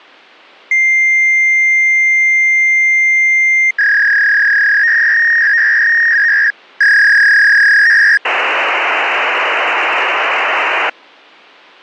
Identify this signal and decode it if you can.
Fax machine handshake, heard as a long tone, a warble and hiss.